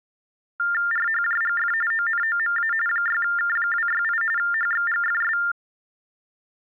TTY/TDD text telephone tones (45.45 baud Baudot), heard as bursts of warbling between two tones, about 400 Hz shift, 1600 Hz centre. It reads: RHJGF ONOMA 6K268 HXGFS